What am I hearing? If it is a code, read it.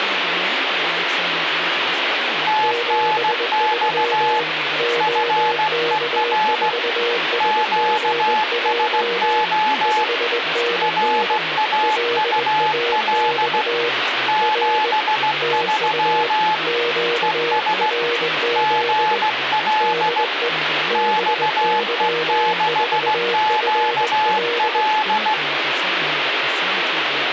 Morse code, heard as two keyed tones, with radio static and speech in English. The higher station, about 16 wpm, 860 Hz: TNX FER QSO RAUL 73 ES GL XE6QL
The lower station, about 20 wpm, 470 Hz: 73 OK4SGJ 5NN LAX R TU QRZ DE BY4FL